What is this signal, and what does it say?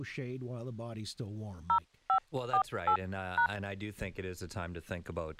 DTMF, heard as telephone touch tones, dialled by hand, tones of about 80 ms, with speech in English. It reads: 0548#